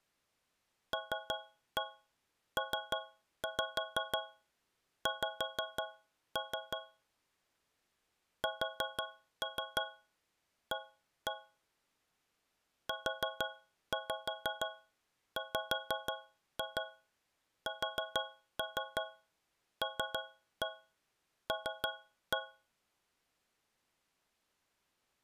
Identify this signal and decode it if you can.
Tap code, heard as taps on a metal pipe, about 6 knocks a second. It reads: LPX SA UWSLL